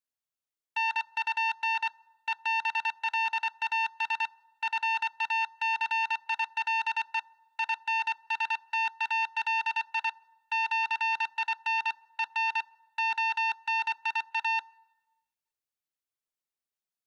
Morse code (with Esperanto letters), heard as a keyed tone, hand-sent with a paddle, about 24 wpm, 900 Hz. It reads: NUN EBLAS FACILE INSTALI ĜIN EN ONIA